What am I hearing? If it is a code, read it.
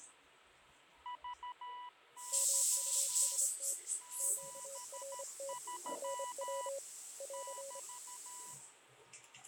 Morse code, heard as two keyed tones, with radio static, fading and the noise of a restroom. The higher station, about 13 wpm, 980 Hz: VY 73 <BT>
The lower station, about 25 wpm, 550 Hz: MUST QRT NW <AR>